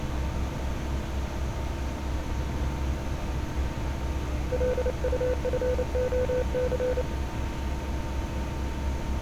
Morse code, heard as a keyed tone, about 29 wpm, 500 Hz, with street noise. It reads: LUFOC